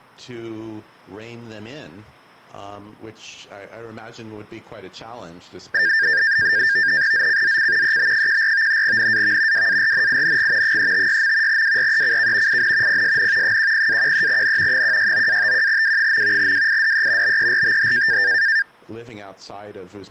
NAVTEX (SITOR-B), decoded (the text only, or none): ZCZC EB14 NAV WARNING 356. WRECK IN PSN 10-13N 169-51W. WIDE BERTH